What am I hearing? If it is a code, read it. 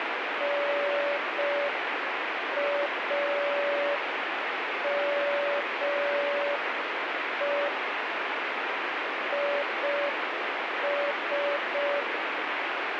Morse code, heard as a keyed tone, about 5 wpm, 570 Hz, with heavy radio static. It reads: NAME IS